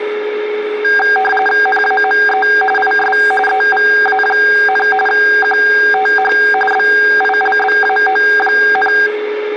RTTY (45.45 baud, 850 Hz shift), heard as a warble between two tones, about 1190 Hz centre, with radio static, a steady whistle near 420 Hz and speech in English. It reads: NAME IS EVA, QTH BILBAO,